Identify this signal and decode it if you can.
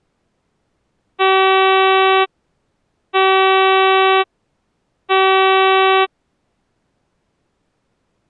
Ship horn signal, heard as a ship's horn, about 380 Hz. 3 short. At sea: I am operating astern propulsion.